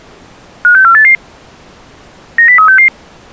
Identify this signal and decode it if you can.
Five-tone selective call (CCIR), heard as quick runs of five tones, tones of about 100 ms. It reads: 56488 90366